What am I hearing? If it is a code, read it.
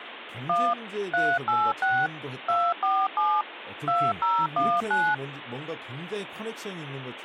DTMF, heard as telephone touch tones, dialled by machine, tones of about 240 ms, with phone line noise and speech in Korean. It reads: 1 386 247 2019